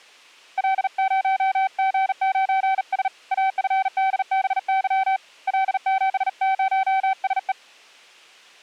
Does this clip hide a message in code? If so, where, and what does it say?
Yes: Morse code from 0.5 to 7.6 s, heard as a keyed tone, hand-sent with a bug key, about 39 wpm, 770 Hz. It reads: L0G9S AFDBY L70SE